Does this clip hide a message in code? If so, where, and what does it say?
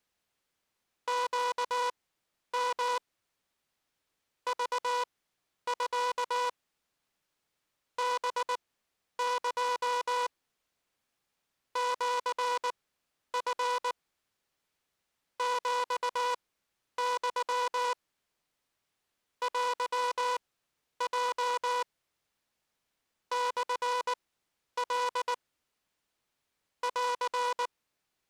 Yes: Morse code (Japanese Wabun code) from 1.0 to 28.3 s, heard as a buzzer, machine-sent, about 19 wpm, spaced as for 10 wpm. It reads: ネヨ クミ ハエ シチ ヒユ テヲ モカ …